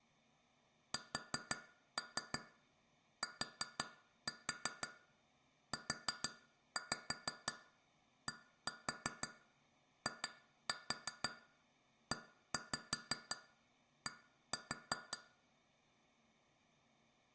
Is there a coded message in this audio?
Yes: tap code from 0.9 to 15.2 s, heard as taps on glass, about 5 knocks a second, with room echo. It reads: STUDIED